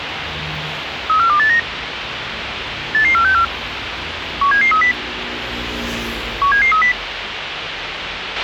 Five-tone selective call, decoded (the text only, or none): 34289 88464 17730 17730